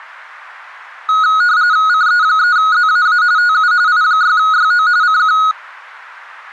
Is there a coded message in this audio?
Yes: RTTY (45.45 baud, 170 Hz shift) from 1.1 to 5.5 s, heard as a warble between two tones, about 1360 Hz centre. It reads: CE3ZAA TU I6YO CQ